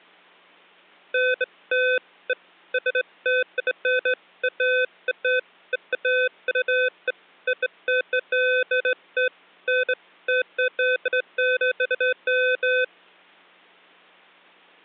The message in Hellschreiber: none

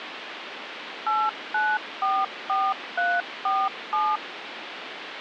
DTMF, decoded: 8944347

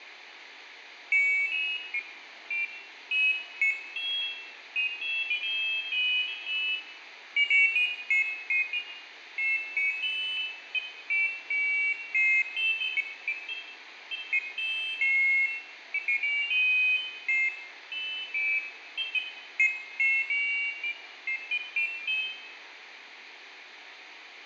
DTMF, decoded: none

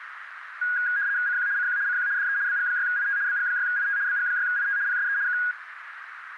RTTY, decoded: CQ CQ CQ DE BG6IT BG6IT BG6IT PSE K

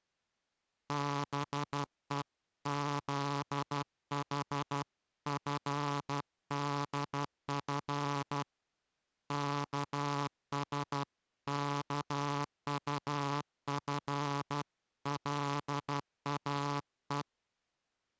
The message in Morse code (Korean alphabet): 다투는 여인과

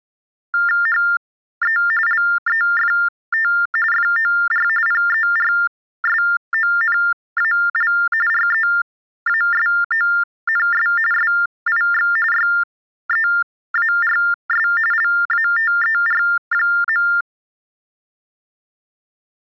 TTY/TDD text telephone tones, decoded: HE LEFT FOR PERSONAL REASONS SIX YEARS LATER.

